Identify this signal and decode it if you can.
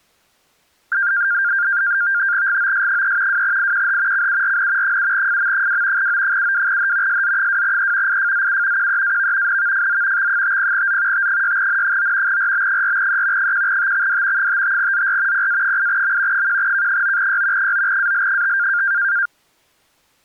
NAVTEX (SITOR-B), 100 baud, 170 Hz shift, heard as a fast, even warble, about 1500 Hz centre. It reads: GOS3 2IQH CURN 7FM2 O72H SZ2E IFZU QEAV NVFZ X50Z T6N9 RB4E 1TXD 55ZR PA8M 1K9Y 9AL5